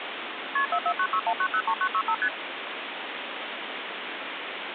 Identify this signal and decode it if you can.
Multi-frequency trunk signalling (R1, as on North American trunks), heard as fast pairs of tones, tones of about 70 ms, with phone line noise. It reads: KP 44961903965 ST